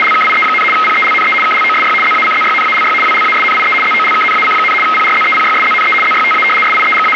RTTY (75 baud, 850 Hz shift), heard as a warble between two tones, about 1700 Hz centre, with radio static. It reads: … PELNE KLOSY ZACZYNALY WLASNIE ZOLKNAC, PRZEPYSZNE ZYTA …